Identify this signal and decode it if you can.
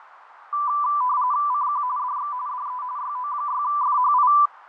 RTTY (45.45 baud, 170 Hz shift), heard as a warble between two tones, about 1080 Hz centre, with radio static, fading and a narrow filter. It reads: CQ DX DE YO6FHI